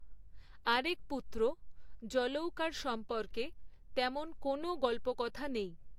Speech in Bangla. There is no code.